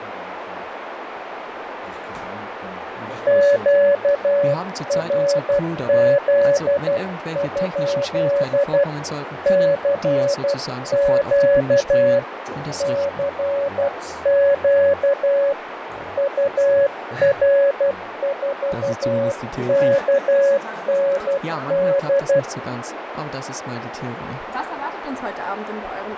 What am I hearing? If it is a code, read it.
Morse code, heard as a keyed tone, hand-sent with a paddle, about 12 wpm, 560 Hz, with radio static, fading and a narrow filter. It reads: QRZ? CQ CQ UR4KND